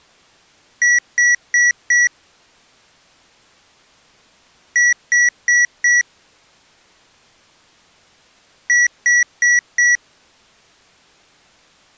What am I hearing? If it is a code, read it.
Beep code, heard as beeps from a small speaker, played three times, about 1950 Hz. 4 short. In AMI BIOS tables: system timer failure; in Dell tables: memory read or write failure.